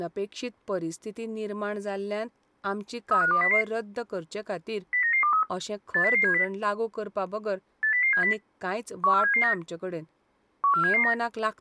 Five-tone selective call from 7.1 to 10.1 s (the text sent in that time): 80070 14779